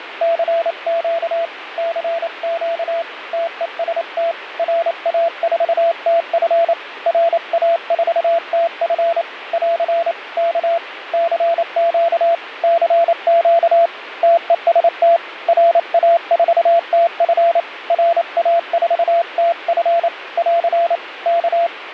Morse code, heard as a keyed tone, hand-sent with a paddle, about 28 wpm, 680 Hz, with radio static and fading. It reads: CQ CQ TEST RA4TF RA4TF <AR> K CQ CQ TEST RA4TF RA4TF <AR> K